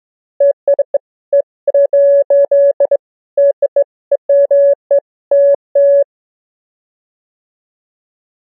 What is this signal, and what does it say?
Beeps of irregular length. There is no code.